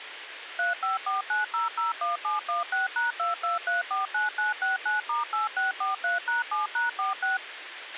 DTMF, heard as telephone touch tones, dialled by machine, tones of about 150 ms, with radio hiss and a squelch burst at the end. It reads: 3549001716#22349969*8643#7#46